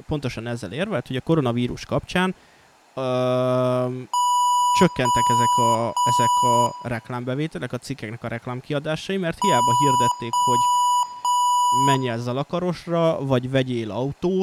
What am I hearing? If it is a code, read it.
Beep code, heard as beeps from a small speaker, played twice, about 980 Hz, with room echo and speech in Hungarian. 3 long. In IBM BIOS tables: keyboard card error.